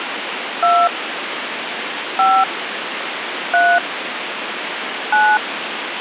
DTMF, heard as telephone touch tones, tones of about 250 ms, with phone line noise. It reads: 2 5 3 9